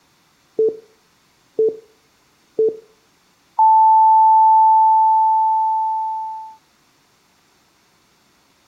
Radio time signal (three low pips and a long one an octave up, as on NHK), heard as pips, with room echo.